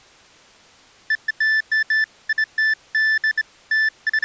Beeps of irregular length. There is no code.